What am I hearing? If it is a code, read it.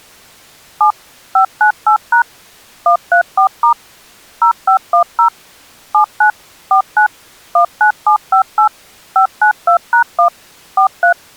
DTMF, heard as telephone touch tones, dialled by machine, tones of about 100 ms. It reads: 7 598# 134* 0510 79 49 19758 592#1 43